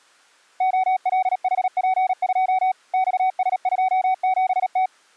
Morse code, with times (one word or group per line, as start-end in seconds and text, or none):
0.6-2.7 OLHP2
2.9-4.9 XS27T